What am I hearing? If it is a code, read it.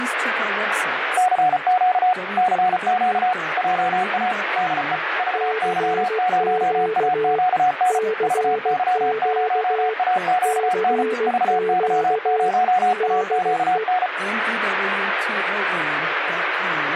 Morse code, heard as two keyed tones, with radio static. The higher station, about 34 wpm, 730 Hz: CQ CQ JA DE VY0AQN VY0AQN VY0AQN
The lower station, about 16 wpm, 440 Hz: CQ CQ CQ DE